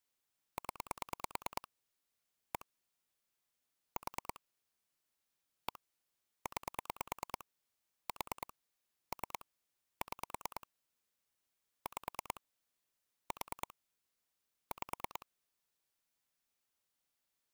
Pulse dialling, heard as clicks on a phone line, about 9 pulses a second. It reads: 0 1 4 1 9 4 3 6 5 4 5